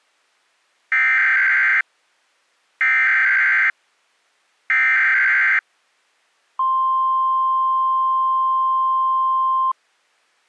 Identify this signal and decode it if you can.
Emergency Alert System (SAME) tones (header bursts, then the 1050 Hz attention tone), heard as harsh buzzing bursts, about 520.83 baud.